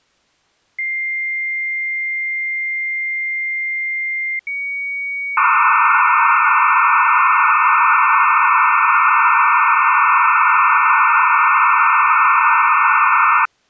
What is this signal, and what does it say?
Dial-up modem handshake (low-speed, two carriers), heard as two whistles, then hiss.